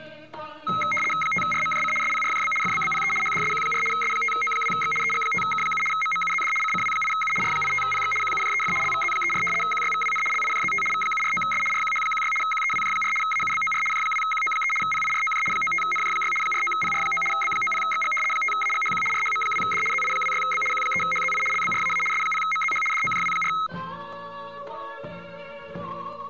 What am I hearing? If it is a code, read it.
RTTY (75 baud, 850 Hz shift), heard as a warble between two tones, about 1700 Hz centre. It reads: 5RMJC SPRJB FBBPE HDSQ4 S5O2X EG5K7 MMUZD CCW8U R85PX QUJEF LVZ34 QYVWN LIJZT V749S RQH16 QEWJ4 AUBOR J2QO3 PIROJ 95NJ6 49PR9 B90XG 5AGHQ RHM2D ZI26B Q3HZI LBRAA S0MZH DOJW4